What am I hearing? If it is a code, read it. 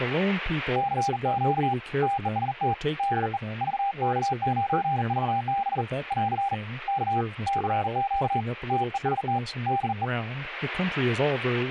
Morse code, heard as a keyed tone, hand-sent with a bug key, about 40 wpm, 800 Hz, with speech in English. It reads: CQ TEST DE VK9VB <AR> K CQ TEST DE